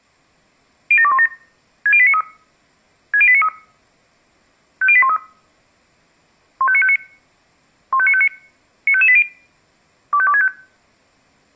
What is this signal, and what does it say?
Five-tone selective call (ZVEI), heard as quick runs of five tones, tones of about 70 ms. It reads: 07217 60893 60893 50813 15959 15959 95580 25265